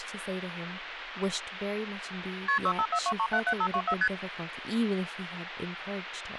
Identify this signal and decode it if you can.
Multi-frequency trunk signalling (R1, as on North American trunks), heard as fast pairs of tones, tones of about 70 ms, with phone line noise and speech in English. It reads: KP 6542377524 ST